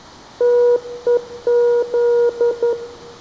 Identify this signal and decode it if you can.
Morse code (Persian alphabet), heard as a keyed tone, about 11 wpm, 480 Hz, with room echo. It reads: تهز